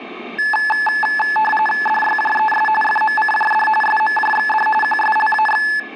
RTTY (45.45 baud, 850 Hz shift), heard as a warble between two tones, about 1290 Hz centre, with radio static and room echo. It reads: DYJES FMCJD SMJXD QSLAX